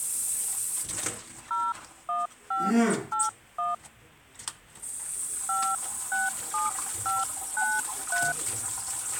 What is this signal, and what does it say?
DTMF, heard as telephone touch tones, dialled by hand, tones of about 200 ms, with kitchen noise. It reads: 01581 567593